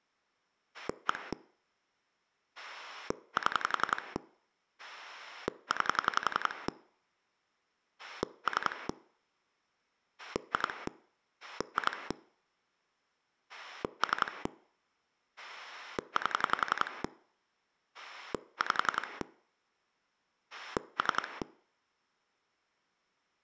Pulse dialling, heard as a rotary dial, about 11 pulses a second. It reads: 1 7 9 3 2 2 3 8 5 3